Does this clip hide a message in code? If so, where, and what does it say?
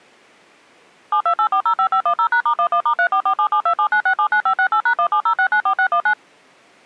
Yes: DTMF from 1.1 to 6.1 s, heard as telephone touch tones, dialled by machine, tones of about 80 ms. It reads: 728405510#*11*34477279679568#170694619